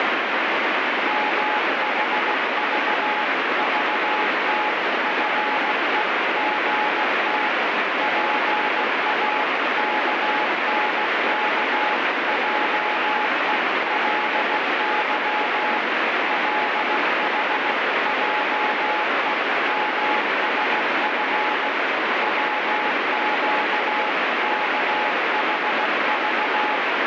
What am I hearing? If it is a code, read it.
Morse code (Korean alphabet), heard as a keyed tone, machine-sent, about 16 wpm, 850 Hz, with heavy radio static. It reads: 물러나서 조용하게 구하면 배울